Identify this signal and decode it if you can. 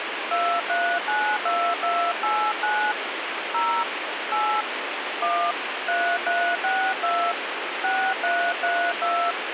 DTMF, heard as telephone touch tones, dialled by hand, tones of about 290 ms, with radio hiss. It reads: 2392289 0 8 1 3362 6332